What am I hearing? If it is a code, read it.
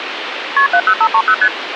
Multi-frequency trunk signalling (R1, as on North American trunks), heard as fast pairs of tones, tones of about 70 ms, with phone line noise. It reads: KP 70530 ST